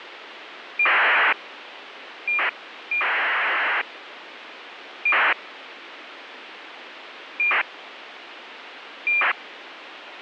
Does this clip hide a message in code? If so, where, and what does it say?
Yes: ACARS aircraft data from 0.8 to 9.3 s, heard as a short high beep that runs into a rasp, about 2400 baud, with radio hiss.